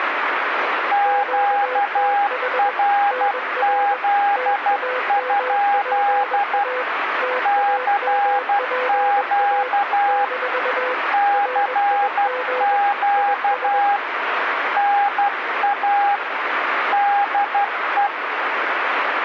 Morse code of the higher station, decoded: QRZ? CQ CQ NA DE

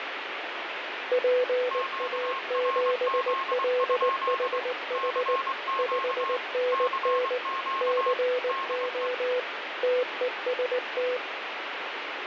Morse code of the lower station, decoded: PA7LHH 5NN CO TEST

